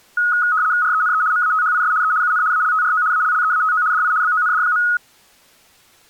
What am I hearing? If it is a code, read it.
RTTY (75 baud, 170 Hz shift), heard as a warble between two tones, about 1360 Hz centre. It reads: RENE MATHIS E UN ALTRO ALLEATO DI BOND.